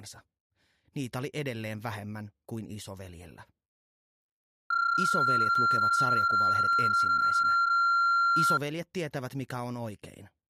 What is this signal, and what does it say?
PSK31 (31.25 baud), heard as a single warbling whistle, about 1380 Hz.